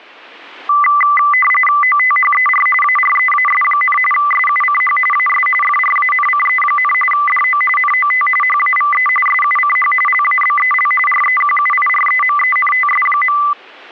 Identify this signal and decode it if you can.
RTTY (45.45 baud, 850 Hz shift), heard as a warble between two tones, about 1600 Hz centre. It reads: OTHER AREAS, SUCH AS FRANCE, DO NOT HAVE SUCH LABEL REQUIREMENTS.